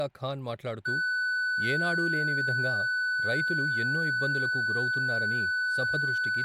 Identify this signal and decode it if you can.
A steady tone, with room echo and speech in Telugu. There is no code.